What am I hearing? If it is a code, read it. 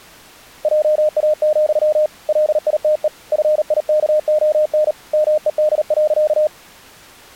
Morse code, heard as a keyed tone, hand-sent with a paddle, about 38 wpm, 610 Hz. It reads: JA, LITE FIKON MED.